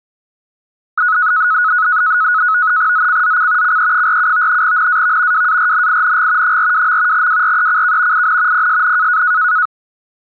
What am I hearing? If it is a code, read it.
NAVTEX (SITOR-B), 100 baud, 170 Hz shift, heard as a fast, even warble, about 1370 Hz centre. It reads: ZCZC CE47 NAV WARNING 42. WRECK IN PSN